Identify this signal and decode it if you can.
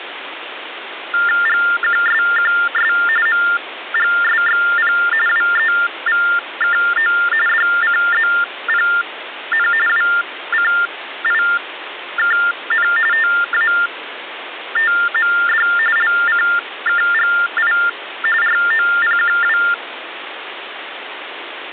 TTY/TDD text telephone tones (45.45 baud Baudot), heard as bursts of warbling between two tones, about 400 Hz shift, 1600 Hz centre, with phone line noise. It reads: GQSQS MGSXP WEVKO DCZPN WCIKN TATMD LCKGI ROPQW